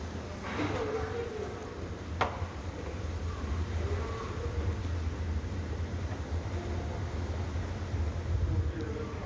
The noise of a subway station. There is no code.